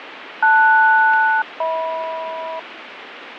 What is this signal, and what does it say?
Aircraft SELCAL, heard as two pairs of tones, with radio static and fading. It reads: LS-HM